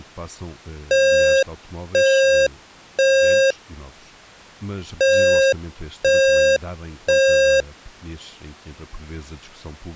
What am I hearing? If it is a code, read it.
Alarm pattern, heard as an alarm's beeps, played twice, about 540 Hz, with speech in Portuguese. Temporal three. Smoke or fire, evacuate.